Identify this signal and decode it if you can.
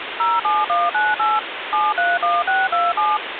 DTMF, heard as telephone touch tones, dialled by machine, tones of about 200 ms, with phone line noise. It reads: 07198 731627